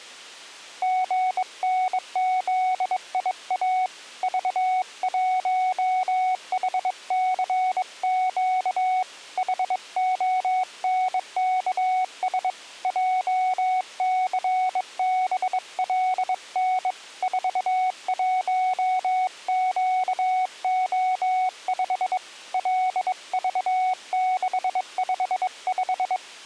Morse code, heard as a keyed tone, hand-sent with a bug key, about 22 wpm, 740 Hz. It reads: GNZIA V1HCQ HONKS JCBLN 41QO5 LV655